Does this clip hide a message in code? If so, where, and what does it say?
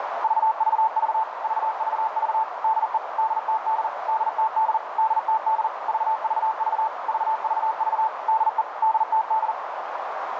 Yes: Morse code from 0.2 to 9.6 s, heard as a keyed tone, machine-sent, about 40 wpm, 880 Hz, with heavy radio static and a narrow filter. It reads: VVV VVV DE DTD DTD DTD VVV VVV DE DTD